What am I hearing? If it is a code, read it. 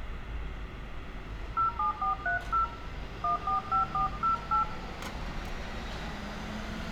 DTMF, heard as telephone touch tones, dialled by hand, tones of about 120 ms, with phone line noise, room echo and street noise. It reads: 07430 145408